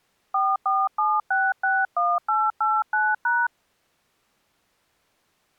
DTMF, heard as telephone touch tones, dialled by hand, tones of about 220 ms. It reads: 447661889#